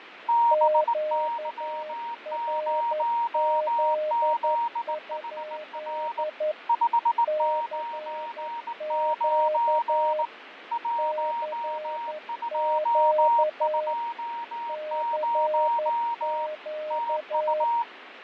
Morse code, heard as two keyed tones, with radio static and fading. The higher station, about 19 wpm, 940 Hz: BY0ZHR 599 1220 TU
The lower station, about 11 wpm, 610 Hz: QRZ? CQ CQ CQ